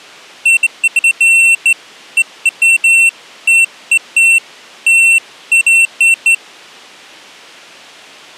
Beeps of irregular length. There is no code.